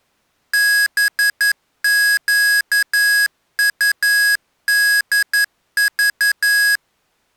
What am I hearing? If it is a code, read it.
Morse code, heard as electronic beeps, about 11 wpm, 1650 Hz. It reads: BQUDV